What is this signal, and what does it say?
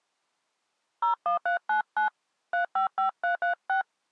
DTMF, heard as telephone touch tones, dialled by hand, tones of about 120 ms. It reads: 01399 355336